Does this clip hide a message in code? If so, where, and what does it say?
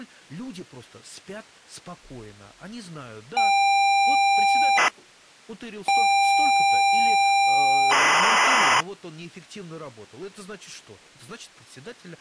Yes: ZX Spectrum tape loading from 3.4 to 8.8 s, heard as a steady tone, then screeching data, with speech in Russian.